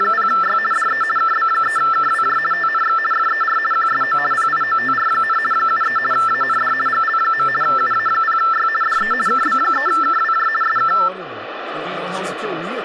RTTY (50 baud, 450 Hz shift), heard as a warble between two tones, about 1550 Hz centre, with radio static and speech in Portuguese. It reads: … DE KB3KWJ TNX FER QSO PIOTR, 73 AND GL. UA0Y DE KB3KWJ SK